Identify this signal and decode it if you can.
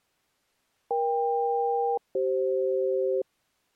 Aircraft SELCAL, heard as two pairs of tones. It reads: EK-CF